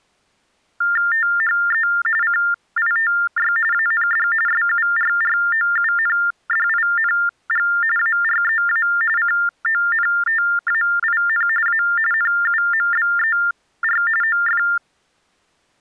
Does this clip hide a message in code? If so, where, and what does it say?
Yes: TTY/TDD text telephone tones (45.45 baud Baudot) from 0.8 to 14.8 s, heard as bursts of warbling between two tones, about 400 Hz shift, 1600 Hz centre. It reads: THE CITY AND SURROUNDING AREA CONTAIN A NUMBER OF